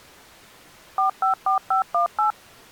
DTMF, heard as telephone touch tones, dialled by machine, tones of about 120 ms. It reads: 454518